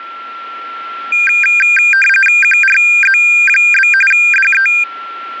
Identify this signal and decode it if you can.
RTTY (45.45 baud, 850 Hz shift), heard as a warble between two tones, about 2000 Hz centre, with a steady whistle near 1360 Hz. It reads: QRZ? DE